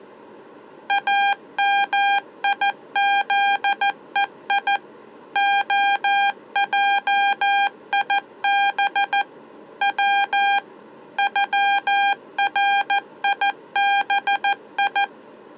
Morse code (Persian alphabet), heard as electronic beeps, machine-sent, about 14 wpm, 800 Hz. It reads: امیزهی عجیب و غریبی